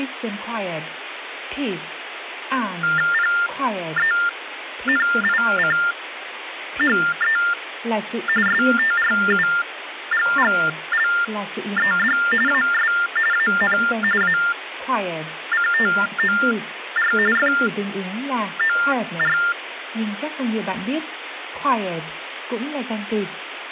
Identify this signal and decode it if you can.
TTY/TDD text telephone tones (45.45 baud Baudot), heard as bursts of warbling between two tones, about 400 Hz shift, 1600 Hz centre, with phone line noise and speech in Vietnamese. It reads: PENICHE STRUGGLED AS AN ACTOR FOR